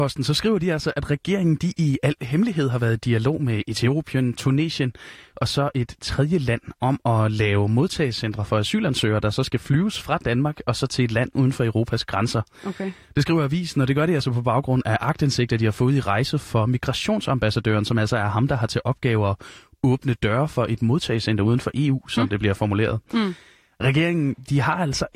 Speech in Danish. There is no code.